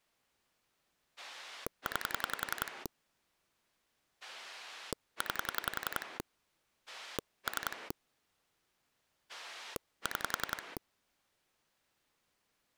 Pulse dialling, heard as a rotary dial, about 10 pulses a second. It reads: 9 9 3 6